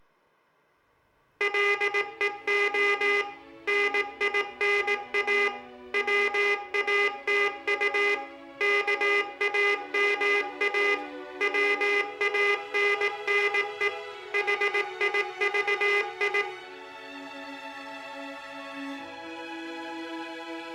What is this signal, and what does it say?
Morse code, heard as a buzzer, machine-sent, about 18 wpm, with room echo. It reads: LEO NINA WATU KAMA WANNE HIVI